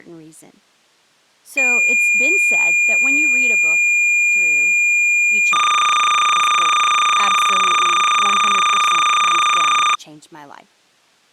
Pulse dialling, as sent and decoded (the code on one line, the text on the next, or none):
none